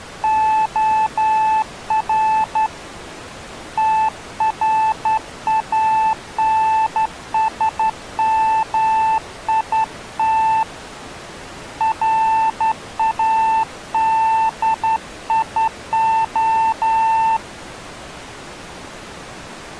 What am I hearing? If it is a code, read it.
Morse code, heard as a keyed tone, hand-sent with a straight key, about 11 wpm, 880 Hz. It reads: OR TRANSMIT RADIO